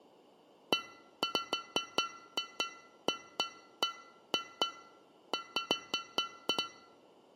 Irregular taps on a metal pipe. There is no code.